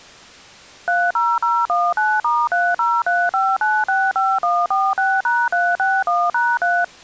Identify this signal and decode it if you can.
DTMF, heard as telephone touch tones, dialled by machine, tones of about 230 ms. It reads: 30019*3035965146#361#3